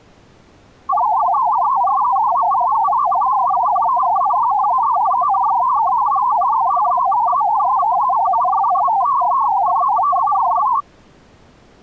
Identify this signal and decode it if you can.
Multi-tone FSK (Olivia or MFSK type), about 500 Hz wide, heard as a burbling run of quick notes, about 62.5 baud.